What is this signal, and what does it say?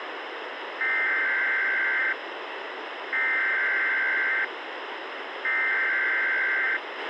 Emergency Alert System (SAME) tones (header bursts), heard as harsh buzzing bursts, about 520.83 baud, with radio hiss and a squelch burst at the end.